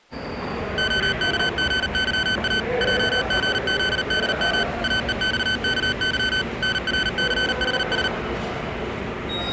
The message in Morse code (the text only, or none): OKGYA JGZDM AEXKY NRCHS